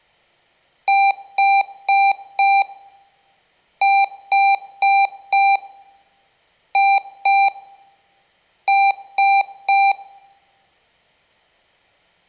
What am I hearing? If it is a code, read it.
Beep code, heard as beeps from a small speaker, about 790 Hz, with room echo. 4-4-2-3.